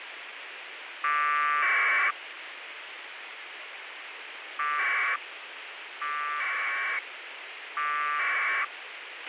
Packet radio (AX.25, as in APRS), 1200 baud, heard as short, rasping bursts, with radio hiss and a squelch burst at the end.